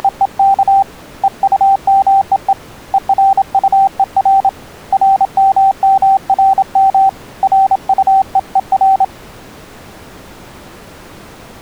Morse code, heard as a keyed tone, hand-sent with a paddle, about 27 wpm, 780 Hz. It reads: … EUMEE ERUER RMMRM RUEER